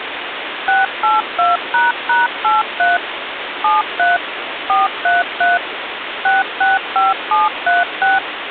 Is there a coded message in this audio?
Yes: DTMF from 0.7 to 8.2 s, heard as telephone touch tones, dialled by machine, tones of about 170 ms, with phone line noise. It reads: 682##83 73 433 665736